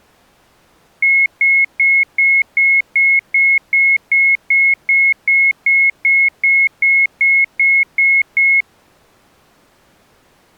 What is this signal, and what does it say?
Evenly repeated beeps. There is no code.